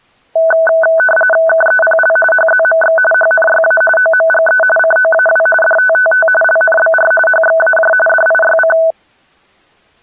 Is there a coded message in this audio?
Yes: RTTY (45.45 baud, 850 Hz shift) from 0.4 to 8.9 s, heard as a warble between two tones, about 1080 Hz centre. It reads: KEPL HZMX HNYA OMGE COAW DTTT LNBR HXAJ DIYC